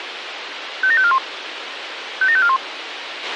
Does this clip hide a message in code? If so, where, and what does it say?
Yes: five-tone selective call (ZVEI) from 0.8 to 2.6 s, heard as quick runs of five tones, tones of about 70 ms, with radio hiss and a squelch burst at the end. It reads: 57541 57541